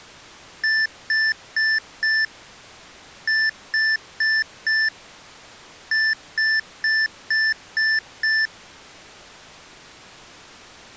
Beep code, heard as beeps from a small speaker, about 1750 Hz. 4-4-6.